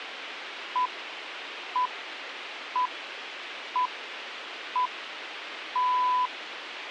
Radio time signal (six pips, as the Greenwich Time Signal), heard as pips, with radio hiss.